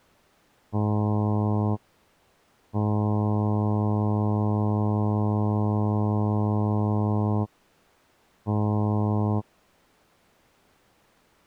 Ship horn signal, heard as a ship's horn, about 100 Hz. 1 short, 1 long, 1 short. At sea: a vessel at anchor warns of its position.